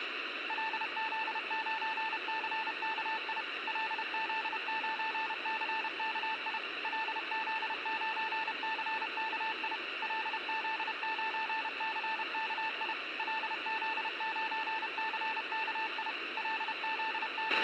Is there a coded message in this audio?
Yes: Morse code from 0.4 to 17.6 s, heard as a keyed tone, machine-sent, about 31 wpm, 880 Hz, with a squelch burst at the end. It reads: LZ9CKI LZ9CKI LZ9CKI LZ9CKI LZ9CKI …